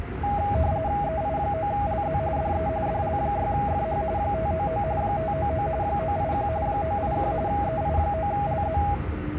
RTTY (45.45 baud, 170 Hz shift), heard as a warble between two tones, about 730 Hz centre, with the noise inside a subway train. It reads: EI9LZ DE DL6FH 599 599 981 981 EI9LZ